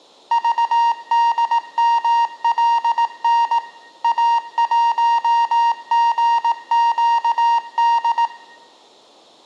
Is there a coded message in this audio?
Yes: Morse code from 0.3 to 8.3 s, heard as electronic beeps, machine-sent, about 18 wpm, 930 Hz, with room echo. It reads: VDMLN A1GQD